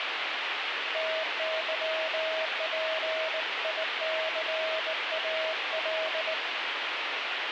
Morse code, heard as a keyed tone, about 19 wpm, 640 Hz, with radio static. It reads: TYPICAL